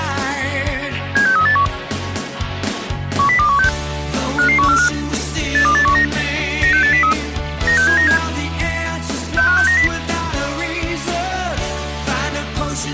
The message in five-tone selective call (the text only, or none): 76381 10216 55145 82819 96803 96797 65690